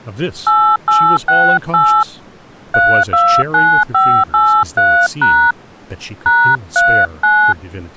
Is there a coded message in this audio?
Yes: DTMF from 0.5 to 7.5 s, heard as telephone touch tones, dialled by hand, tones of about 290 ms, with speech in English. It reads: 8868 329583# #39